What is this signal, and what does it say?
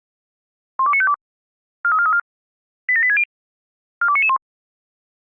Five-tone selective call (ZVEI), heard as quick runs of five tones, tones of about 70 ms. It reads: 12952 43434 87860 42991